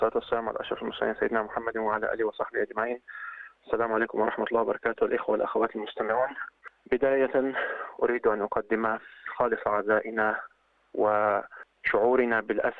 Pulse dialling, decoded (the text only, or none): none